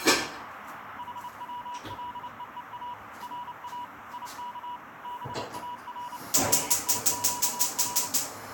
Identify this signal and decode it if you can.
Morse code (Persian alphabet), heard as a keyed tone, machine-sent, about 29 wpm, 970 Hz, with radio static, a narrow filter and kitchen noise. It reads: حولهها را یک بار دیگر